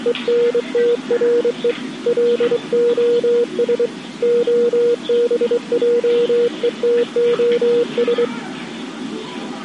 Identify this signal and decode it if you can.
Morse code, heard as a keyed tone, hand-sent with a straight key, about 24 wpm, 480 Hz, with the noise of a park. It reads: ENTRE LOS OBJETOS